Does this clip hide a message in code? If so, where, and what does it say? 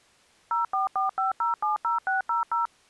Yes: DTMF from 0.5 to 2.7 s, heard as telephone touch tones, dialled by machine, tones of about 140 ms. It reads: 0445070600